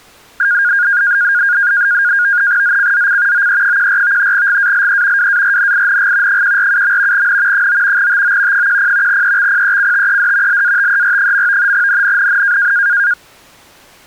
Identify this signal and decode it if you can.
NAVTEX (SITOR-B), 100 baud, 170 Hz shift, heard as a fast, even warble, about 1550 Hz centre. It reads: ZCZC OE14 GALE WARNING 147. N 9 TO 10 EXPECTED LATER. NNNN